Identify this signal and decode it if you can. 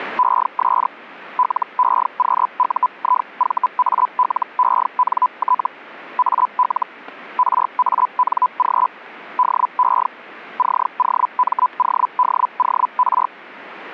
Hellschreiber (Feld-Hell, 122.5 baud), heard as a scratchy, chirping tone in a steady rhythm, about 1000 Hz, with static crashes. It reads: ES LEQUIVALENT AL RANG DE COMODOR